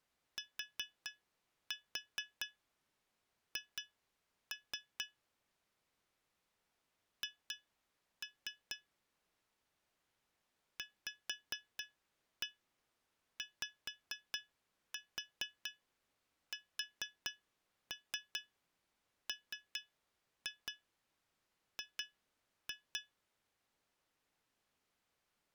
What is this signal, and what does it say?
Tap code, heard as taps on glass, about 4 knocks a second. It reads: TH H VYSMG